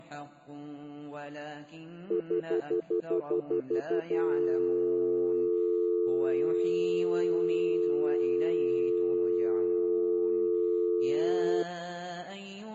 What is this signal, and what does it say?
Telephone call progress tone (North American plan), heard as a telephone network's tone, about 350, 440 Hz, 0.1 s on and 0.1 s off. Stutter dial tone.